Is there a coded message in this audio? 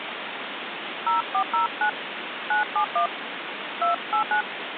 Yes: DTMF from 1.1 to 4.4 s, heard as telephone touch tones, dialled by hand, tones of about 110 ms, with phone line noise. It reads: 0409 971 289